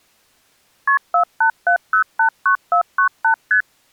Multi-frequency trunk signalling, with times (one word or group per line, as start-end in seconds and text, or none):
0.9-1.0 KP
1.1-3.3 487089498
3.5-3.6 ST